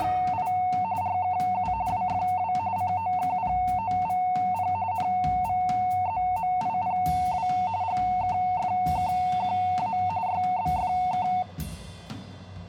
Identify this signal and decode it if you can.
RTTY (45.45 baud, 170 Hz shift), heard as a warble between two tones, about 820 Hz centre. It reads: … RKU WFW COKPOVP NVZMIPW GKFKQA YBFK